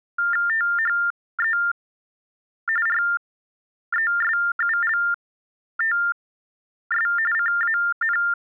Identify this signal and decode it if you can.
TTY/TDD text telephone tones (45.45 baud Baudot), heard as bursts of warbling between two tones, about 400 Hz shift, 1600 Hz centre. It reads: THE RESULTS CAN